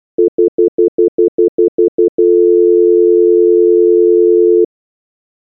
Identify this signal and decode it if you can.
Telephone call progress tone (North American plan), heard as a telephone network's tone, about 350, 440 Hz, 0.1 s on and 0.1 s off. Stutter dial tone.